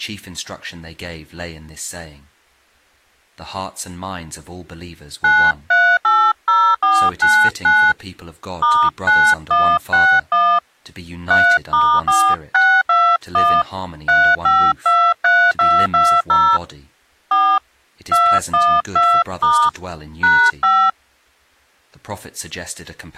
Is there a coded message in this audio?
Yes: DTMF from 5.2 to 20.9 s, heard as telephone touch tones, dialled by hand, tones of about 270 ms. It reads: 9380499 *9161 3*4621 3523220 4 212* #5